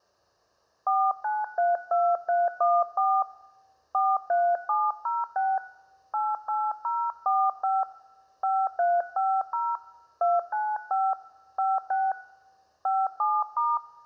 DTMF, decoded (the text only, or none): 4932314 43706 88045 5350 295 56 57*